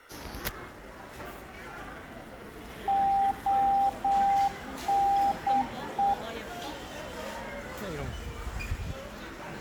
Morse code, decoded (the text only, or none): ONE